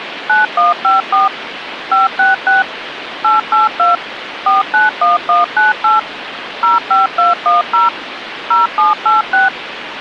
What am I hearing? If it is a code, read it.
DTMF, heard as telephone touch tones, dialled by machine, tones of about 160 ms, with phone line noise. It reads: 9154 566 882 491198 05210 0786